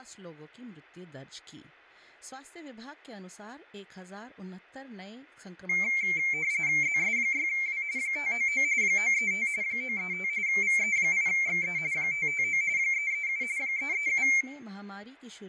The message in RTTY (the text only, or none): ZS6W 599 935 935 VE8XE 559 337 337